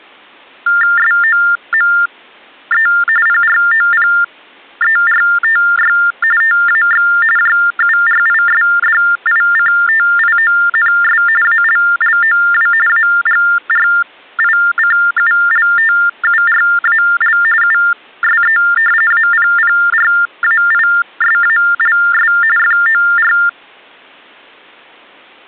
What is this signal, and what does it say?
TTY/TDD text telephone tones (45.45 baud Baudot), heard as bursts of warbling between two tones, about 400 Hz shift, 1600 Hz centre. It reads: SOME PROPERTY TAX JURISDICTIONS ALLOW AGRICULTURAL USE APPRAISALS FOR